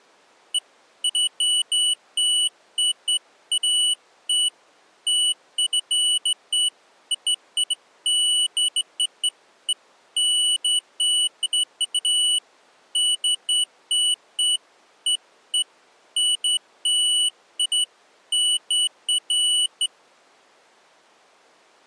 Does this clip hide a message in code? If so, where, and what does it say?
No, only beeps of irregular length.